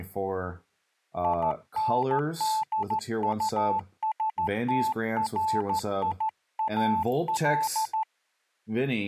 Morse code, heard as a keyed tone, hand-sent with a straight key, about 14 wpm, 880 Hz, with speech in English. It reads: INDUSTRIAL